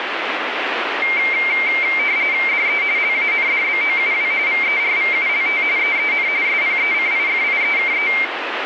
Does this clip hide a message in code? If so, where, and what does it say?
Yes: RTTY (45.45 baud, 170 Hz shift) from 1.0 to 8.2 s, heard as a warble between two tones, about 2200 Hz centre, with radio static. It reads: DE LANDBOUW VERVULT EEN SPECIFIEKE